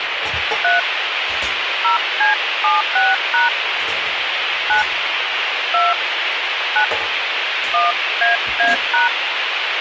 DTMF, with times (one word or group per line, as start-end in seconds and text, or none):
0.6-0.8 3
1.8-3.5 0C76#
4.7-4.8 9
5.7-5.9 2
6.8-6.8 9
7.7-9.1 1AA#